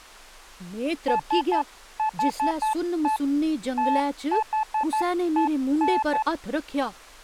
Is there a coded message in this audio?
Yes: Morse code (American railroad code) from 1.0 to 6.3 s, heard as a keyed tone, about 870 Hz, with speech in Dogri. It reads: SHE THEN